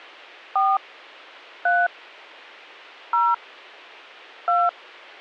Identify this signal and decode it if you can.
DTMF, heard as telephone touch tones, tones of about 220 ms. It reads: 4 3 0 2